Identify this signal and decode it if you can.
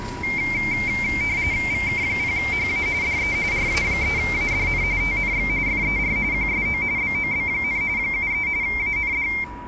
RTTY (45.45 baud, 170 Hz shift), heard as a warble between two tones, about 2200 Hz centre, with a steady whistle near 970 Hz and the noise of a residential street. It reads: VK0HA DE RA3ADN TNX FER QSO BOB, 73 AND